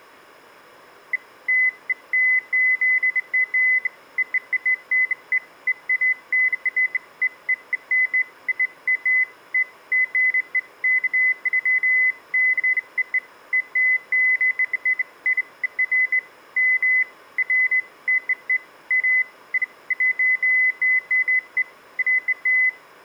Beeps of irregular length. There is no code.